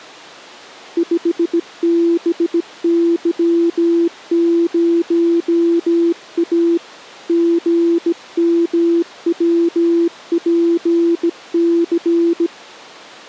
Morse code, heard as a keyed tone, hand-sent with a bug key, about 17 wpm, 340 Hz. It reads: 5BY0A GMWPC